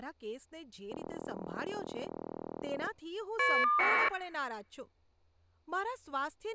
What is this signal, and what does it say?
Caller ID data burst, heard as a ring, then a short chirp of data, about 1200 baud, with speech in Gujarati.